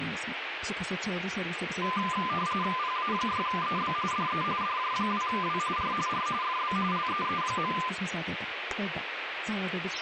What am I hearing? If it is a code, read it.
RTTY (45.45 baud, 170 Hz shift), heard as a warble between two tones, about 1110 Hz centre, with radio static. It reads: PA6EB DE DJ2W R R FB LEE.